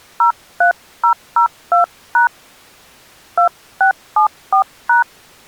DTMF, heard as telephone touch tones, dialled by hand, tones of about 110 ms. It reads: 03002# 2674#